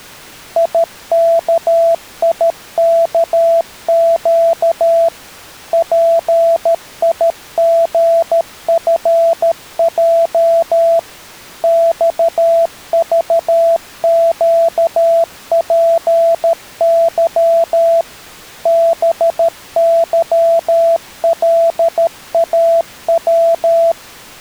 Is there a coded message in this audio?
Yes: Morse code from 0.5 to 24.0 s, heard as a keyed tone, machine-sent, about 13 wpm, 670 Hz. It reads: IKIKQ PIGFJ XVQPY BYLAW